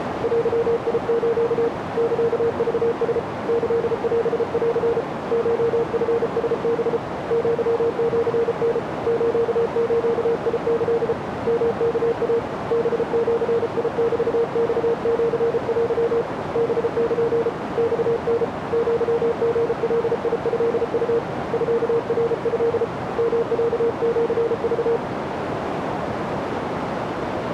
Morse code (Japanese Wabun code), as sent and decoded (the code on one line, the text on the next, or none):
.-.-- .. ---.- / -.-.- ...- ... / -.-.. .-... .-.-. / ---- ..-. ... -... / --.-- --.-. -. / ---.- ---.- .. -.-.. / -- -.- .- / -... --.-. .. -...- -..- --.-. .-.-- / -... -.--. / -..- -. / --.-- --. .-.. .. ..-.. ..- / ..-.- .-. ..-.. / -- .-.- --.-. ...-
デス サクラ キオン コチラハ アシタ スズキ ヨワイ ハジメマシテ ハル マタ アリガトウ ミナト ヨロシク